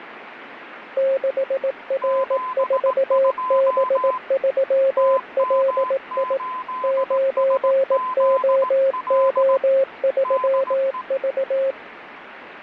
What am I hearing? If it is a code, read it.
Morse code, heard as two keyed tones, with radio static. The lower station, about 18 wpm, 540 Hz: 6R4B3LI 9OO3V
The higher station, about 18 wpm, 1020 Hz: 72 TM8SZL DE